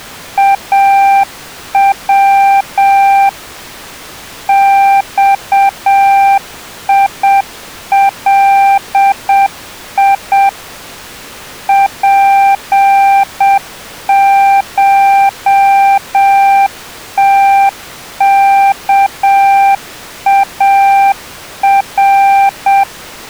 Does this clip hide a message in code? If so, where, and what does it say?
Yes: Morse code (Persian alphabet) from 0.3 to 22.9 s, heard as a keyed tone, machine-sent, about 7 wpm, 790 Hz. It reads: او خیلی پشتکار